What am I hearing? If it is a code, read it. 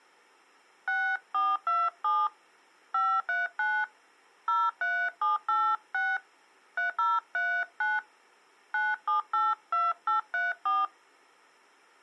DTMF, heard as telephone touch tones, dialled by hand, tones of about 200 ms. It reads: 6427 539 03786 3039 9782834